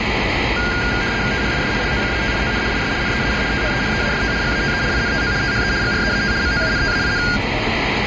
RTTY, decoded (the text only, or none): THIS LOCATION IS NEAR THE EAST GATE INTO THE GREAT MOUNTAIN